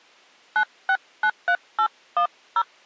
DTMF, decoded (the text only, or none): 9693810